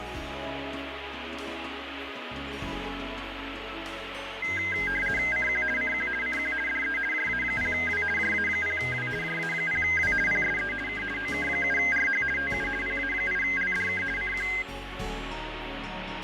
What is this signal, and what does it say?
RTTY (50 baud, 450 Hz shift), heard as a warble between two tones, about 1850 Hz centre, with radio static. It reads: CQ CQ CQ DE JA0W JA0W JA0W PSE K OK7RH TU PA8LDK CQ